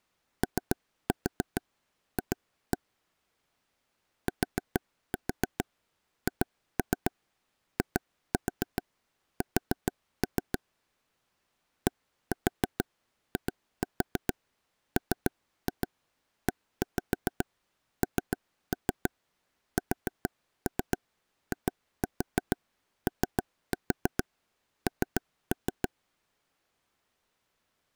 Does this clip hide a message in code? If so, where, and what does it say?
Yes: tap code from 0.4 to 25.9 s, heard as taps on a table, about 6 knocks a second. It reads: OF THIS DIMENSION